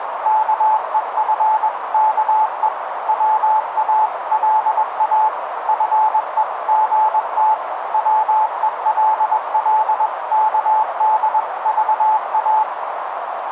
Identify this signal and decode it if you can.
Morse code (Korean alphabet), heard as a keyed tone, machine-sent, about 21 wpm, 870 Hz, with radio static and a narrow filter. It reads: … 보고 나서 밖으로